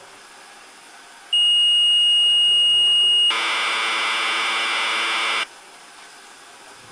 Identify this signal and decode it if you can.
Commodore tape loading (standard loader), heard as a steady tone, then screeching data, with the noise of a restroom.